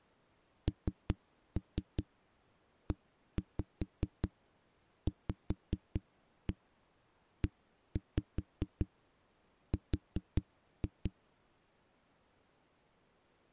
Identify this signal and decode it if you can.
Tap code, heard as knocks on a wall, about 5 knocks a second. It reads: NEVER